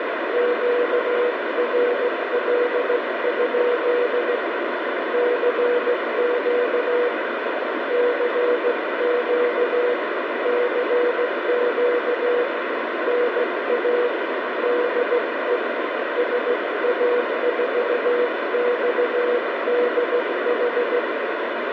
Morse code, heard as a keyed tone, hand-sent with a straight key, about 16 wpm, 490 Hz, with heavy radio static. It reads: QRL? CQ CQ CQ NA DE SA4XDH